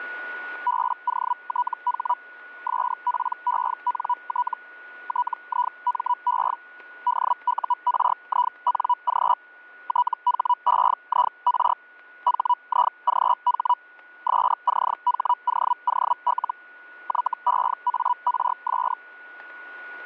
Hellschreiber (Feld-Hell, 122.5 baud), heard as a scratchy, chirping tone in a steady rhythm, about 980 Hz, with static crashes and a steady whistle near 1460 Hz. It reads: BOTH SPENT TIME DURING THEIR HIGH SCHOOL YEARS